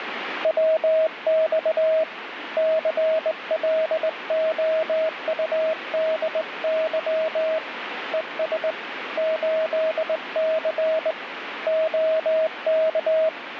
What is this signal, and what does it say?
Morse code, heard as a keyed tone, hand-sent with a straight key, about 20 wpm, 640 Hz, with radio static. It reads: WX CLOUDY ES 8C OK